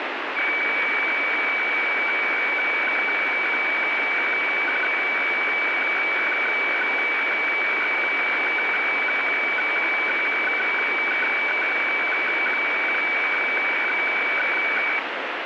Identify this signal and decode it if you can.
Weather fax (radiofax), 120 lines a minute, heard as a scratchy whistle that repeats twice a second, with heavy radio static.